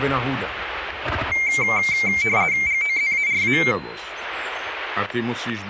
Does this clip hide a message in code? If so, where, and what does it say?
Yes: RTTY (50 baud, 170 Hz shift) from 1.3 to 3.7 s, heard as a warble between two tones, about 2200 Hz centre, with static crashes. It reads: GOZARA